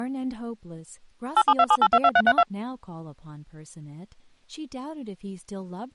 DTMF, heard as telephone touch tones, dialled by machine, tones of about 50 ms, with speech in English. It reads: 8727822332